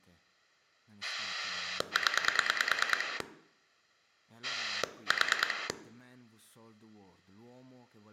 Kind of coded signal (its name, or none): pulse dialling